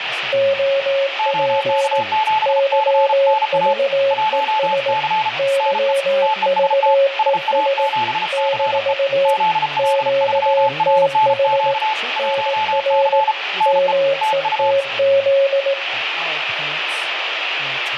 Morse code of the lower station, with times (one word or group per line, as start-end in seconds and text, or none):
0.3-2.0 OP
2.5-4.9 YVES
5.4-7.9 YVES
8.3-9.3 -
9.8-11.7 QTH
12.2-13.2 NR
13.7-15.7 METZ